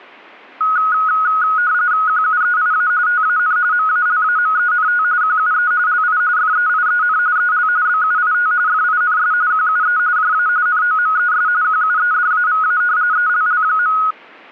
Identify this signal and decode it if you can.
RTTY (45.45 baud, 170 Hz shift), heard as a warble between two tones, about 1360 Hz centre. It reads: QUEIA TAN MALAMENT QUE LI FEIEN EL BUIT FINS QUE JA NOMES QUEDAVA ELL.